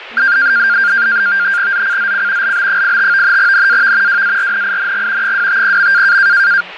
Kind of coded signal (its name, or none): NAVTEX (SITOR-B)